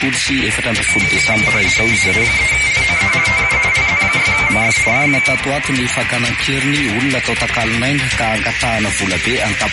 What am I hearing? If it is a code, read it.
RTTY (50 baud, 170 Hz shift), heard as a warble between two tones, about 2200 Hz centre, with radio static and a narrow filter. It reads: AA3LOE TU LZ6MF CQ